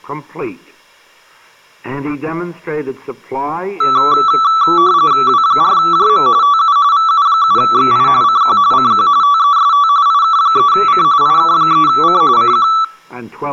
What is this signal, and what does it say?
RTTY (45.45 baud, 170 Hz shift), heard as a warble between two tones, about 1230 Hz centre. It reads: W4JM TU VU7XI CQ CQ TEST IK3C IK3C CQ